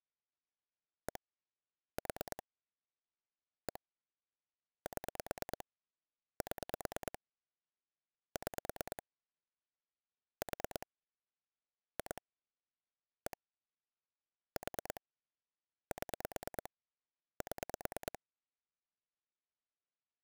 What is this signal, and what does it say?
Pulse dialling, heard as clicks on a phone line, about 9 pulses a second. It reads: 1 4 1 7 7 6 4 2 1 4 7 7